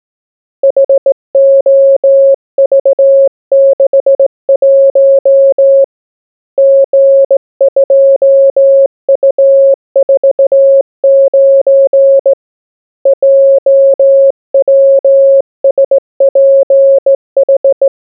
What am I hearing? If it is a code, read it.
Morse code, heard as a keyed tone, hand-sent with a straight key, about 17 wpm, 550 Hz. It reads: HOV61 G2U49 JWSPH